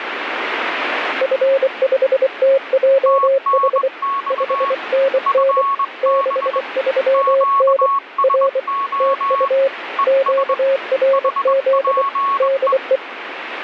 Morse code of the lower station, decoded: F5TJH 5NN 63N R TU QRZ DE

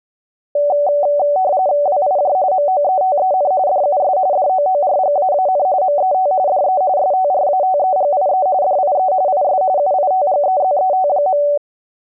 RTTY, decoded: WIJ MOETEN DUS DOORGAAN MET DE STRATEGIE DIE IS UITGEZET.

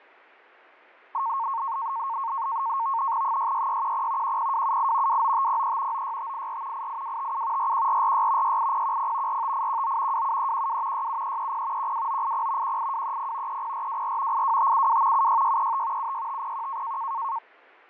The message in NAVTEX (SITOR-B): 66610 10278 29503 96584 88257 41446 68010 45819 27312 67330 12980 18230 30424 82572 76635 76501

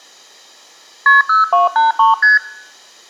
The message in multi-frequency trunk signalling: KP 0283 ST

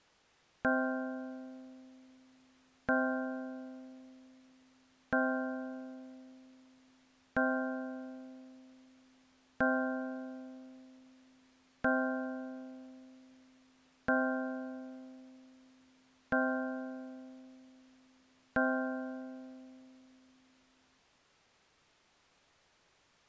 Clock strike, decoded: 9

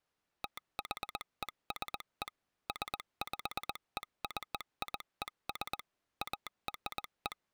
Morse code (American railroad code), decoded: THESE SPECIES ARE

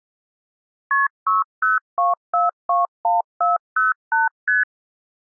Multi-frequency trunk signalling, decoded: KP 602421408 ST

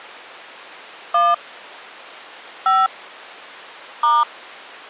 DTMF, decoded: 1 5 *

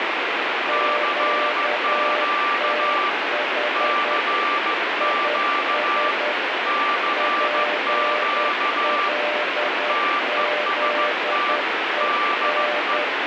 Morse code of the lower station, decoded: QTH IS PLZEN

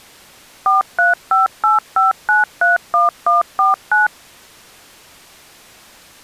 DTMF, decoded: 43585931149

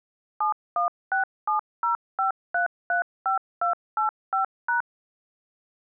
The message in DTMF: 716705335285#

